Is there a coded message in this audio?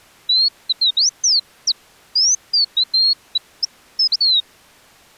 No, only bird-like chirps.